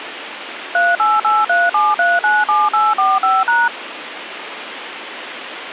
DTMF, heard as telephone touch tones, dialled by machine, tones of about 200 ms, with phone line noise. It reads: 38837397845#